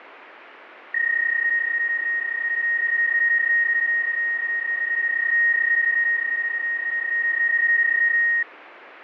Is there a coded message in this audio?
Yes: PSK31 (31.25 baud) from 0.9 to 8.4 s, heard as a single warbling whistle, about 1850 Hz, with radio static.